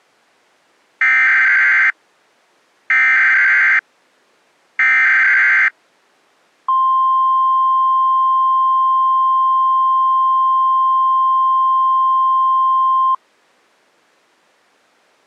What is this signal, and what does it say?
Emergency Alert System (SAME) tones (header bursts, then the 1050 Hz attention tone), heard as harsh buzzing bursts, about 520.83 baud.